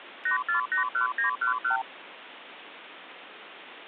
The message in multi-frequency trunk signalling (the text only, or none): 8481911